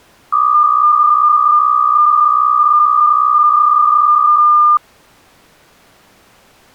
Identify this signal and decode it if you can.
PSK63 (62.5 baud), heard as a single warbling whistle, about 1200 Hz.